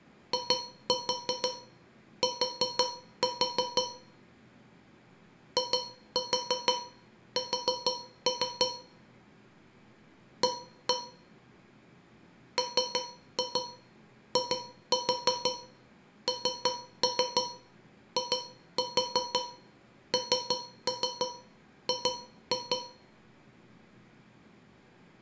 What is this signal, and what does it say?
Tap code, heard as taps on a metal pipe, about 6 knocks a second, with room echo. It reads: IT IS A MINING